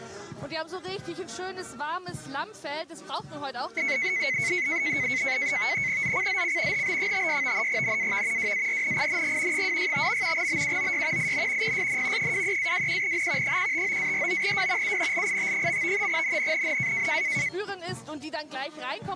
NAVTEX (SITOR-B), 100 baud, 170 Hz shift, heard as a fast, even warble, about 2150 Hz centre. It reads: ZCZC HB56 NAV WARNING 265. BUOY IN PSN 23-21N 159-49W UNLIT. NNNN